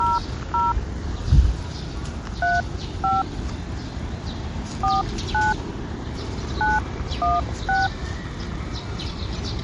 DTMF, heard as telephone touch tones, dialled by hand, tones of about 180 ms, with the noise of a park. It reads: 00 35 49 916